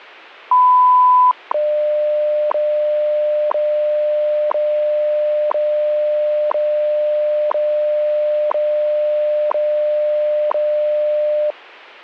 Radio time signal (WWV, Colorado), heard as ticks, one a second.